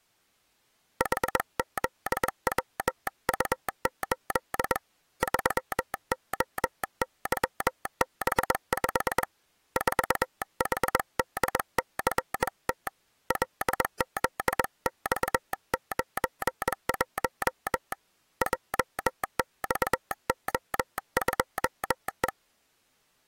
Morse code, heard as a telegraph sounder, hand-sent with a bug key, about 21 wpm. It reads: HZWU8 3OYB5 4HDCT LZX91 JXO2E